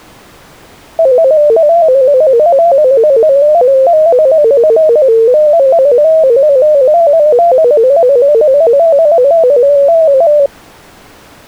Multi-tone FSK (Olivia or MFSK type), about 250 Hz wide, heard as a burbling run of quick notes, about 15.625 baud.